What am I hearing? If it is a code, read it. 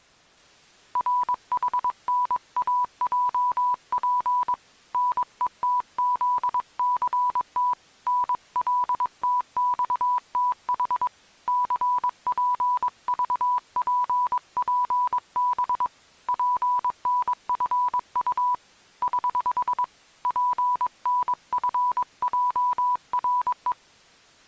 Morse code, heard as a keyed tone, hand-sent with a paddle, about 22 wpm, 990 Hz. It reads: RHNAJP NETZCT NLTXTH CPVPPB PNFU <HH> PNFJRE